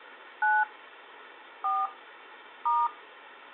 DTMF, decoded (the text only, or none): 9 4 *